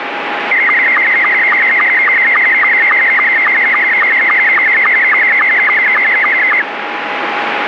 SSTV (slow-scan television), Scottie S2, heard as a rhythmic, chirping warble, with radio static.